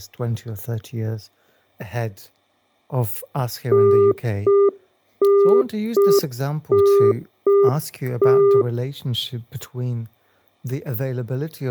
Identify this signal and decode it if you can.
Telephone call progress tone (UK plan), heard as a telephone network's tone, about 400 Hz, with speech in English. Congestion tone.